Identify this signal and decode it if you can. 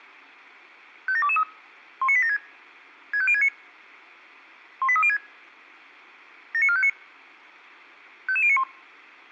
Five-tone selective call (ZVEI), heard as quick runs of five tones, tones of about 70 ms. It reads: 57223 19876 65069 18306 79459 55091